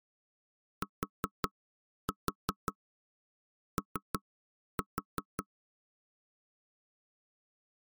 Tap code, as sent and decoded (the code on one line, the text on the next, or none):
4-4 3-4
TO